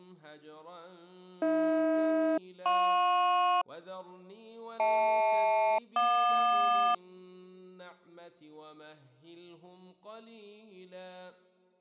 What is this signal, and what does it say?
Aircraft SELCAL, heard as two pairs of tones. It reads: AH-JP HL-JQ